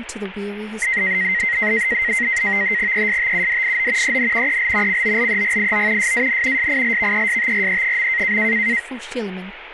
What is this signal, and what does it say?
NAVTEX (SITOR-B), 100 baud, 170 Hz shift, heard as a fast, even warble, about 2000 Hz centre, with radio static and speech in English. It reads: ESTUDIO EN EL COLEGIO SAN SILVESTRE.